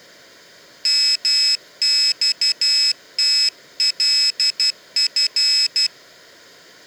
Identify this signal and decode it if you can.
Morse code (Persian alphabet), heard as a high beeper, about 12 wpm, 2600 Hz. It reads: مختلف